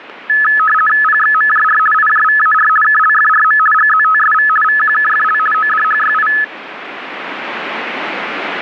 RTTY (50 baud, 450 Hz shift), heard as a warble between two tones, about 1500 Hz centre, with radio static. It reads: PXMJR IJVAR KLFRM GZTSV VQKFL ODHYI